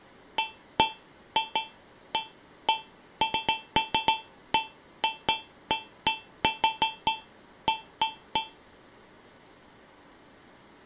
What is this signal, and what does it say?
Irregular taps on a metal pipe. There is no code.